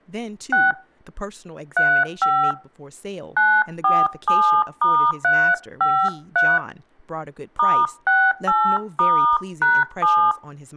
DTMF, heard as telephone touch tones, dialled by hand, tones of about 280 ms, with speech in English. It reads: 6 35 947*353 *68*#7